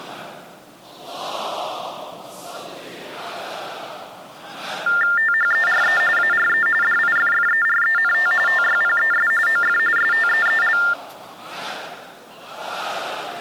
TTY/TDD text telephone tones (45.45 baud Baudot), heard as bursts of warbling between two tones, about 400 Hz shift, 1600 Hz centre. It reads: THERE ARE DIFFERENT TYPES OF STEEL